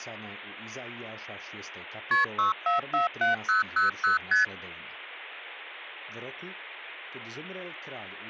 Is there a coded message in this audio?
Yes: multi-frequency trunk signalling (R1, as on North American trunks) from 2.1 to 4.4 s, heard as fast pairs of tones, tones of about 140 ms, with speech in Slovak. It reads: KP 6447000 ST